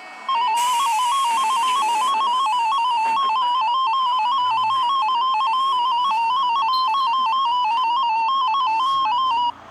Multi-tone FSK (Olivia or MFSK type), about 250 Hz wide, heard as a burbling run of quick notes, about 15.625 baud, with the noise inside a bus.